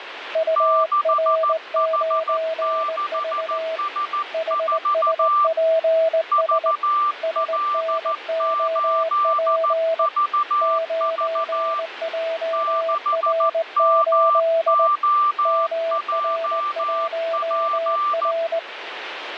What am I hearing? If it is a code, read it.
Morse code, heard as two keyed tones, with radio static. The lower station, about 19 wpm, 650 Hz: UR9V HSPS SNOP 9JR8 MR1R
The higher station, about 14 wpm, 1180 Hz: 6H6S4 VL8VV 6MOJP